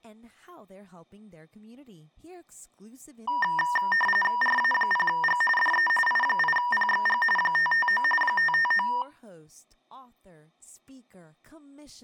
RTTY (45.45 baud, 850 Hz shift), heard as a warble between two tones, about 1400 Hz centre, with speech in English. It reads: RA0G DE I8PXG 559 559